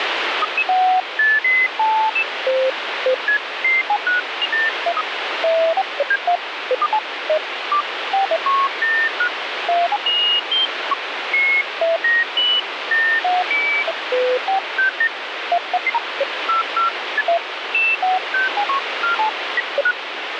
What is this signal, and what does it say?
Electronic bleeps of random pitch and length, with heavy radio static. There is no code.